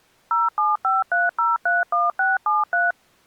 DTMF, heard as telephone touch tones, dialled by machine, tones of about 180 ms. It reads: 0753031673